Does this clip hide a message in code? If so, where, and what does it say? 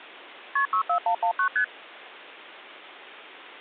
Yes: multi-frequency trunk signalling (R1, as on North American trunks) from 0.6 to 1.6 s, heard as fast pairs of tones, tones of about 90 ms. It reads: KP 64119 ST